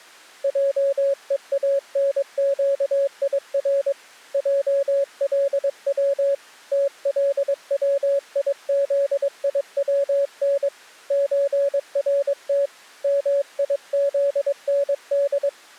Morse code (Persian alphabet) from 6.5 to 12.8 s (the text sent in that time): تلویزیون چرت